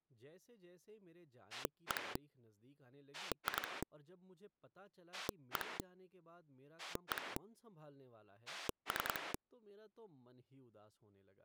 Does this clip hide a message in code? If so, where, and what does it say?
Yes: pulse dialling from 1.5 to 9.4 s, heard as a rotary dial, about 10 pulses a second, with speech in Hindi. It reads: 1 2 1 1 3